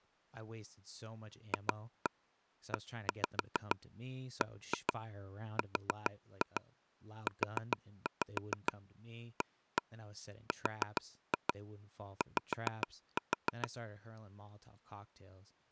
Tap code, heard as taps on a table, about 6 knocks a second, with speech in English. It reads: FEBRUARY